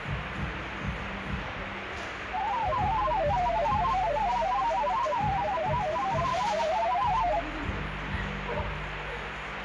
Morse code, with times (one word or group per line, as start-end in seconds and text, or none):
none